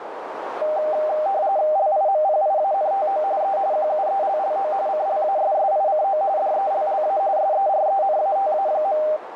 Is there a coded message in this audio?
Yes: RTTY (45.45 baud, 170 Hz shift) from 0.6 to 9.2 s, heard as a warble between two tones, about 700 Hz centre, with radio static and a narrow filter. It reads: LIMPIANTO E QUELLO CLASSICO DELLA SERENATA.